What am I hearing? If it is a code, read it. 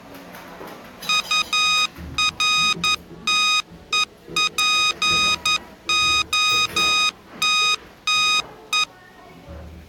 Morse code, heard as electronic beeps, machine-sent, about 11 wpm, 1250 Hz, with the noise of a cafe. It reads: URTEPOTTE